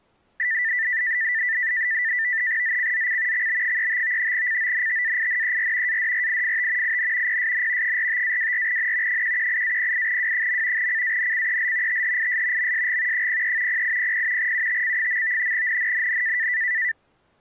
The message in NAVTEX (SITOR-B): ZCZC XB35 CONTAINER ADRIFT IN PSN 45-24N 118-08W. CANCEL THIS MSG 03 0800 UTC. NNNN

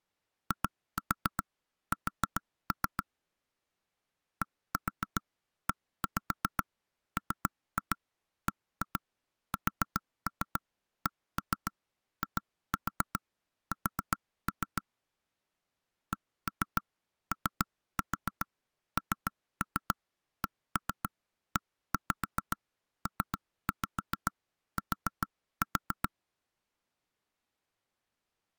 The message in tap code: IS DEMBSKIS CONCEPT

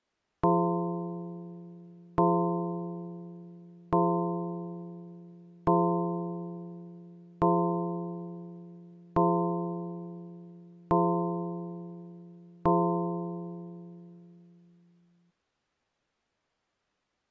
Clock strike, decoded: 8

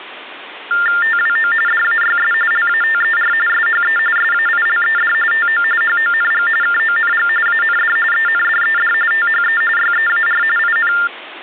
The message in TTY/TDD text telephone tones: TWO DAYS LATER SHE SAILED TO HONG KONG AND ENDED THE YEAR IN

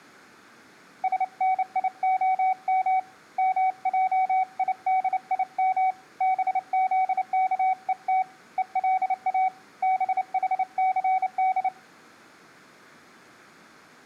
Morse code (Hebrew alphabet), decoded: שניהם מעידים בזכות ולא בחסד

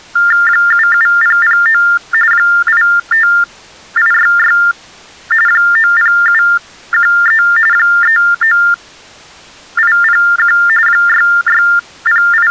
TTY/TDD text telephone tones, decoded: 77009 85866 90713 39801 …

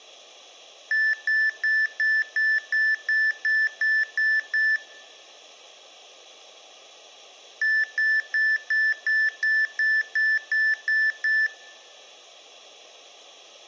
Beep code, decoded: 11 short

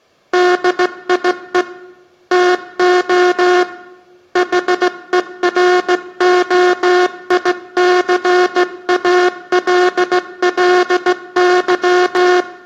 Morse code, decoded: DIE TO HEROICALLY

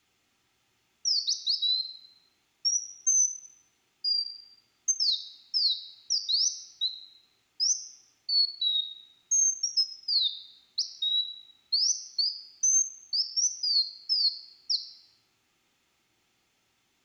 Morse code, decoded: none

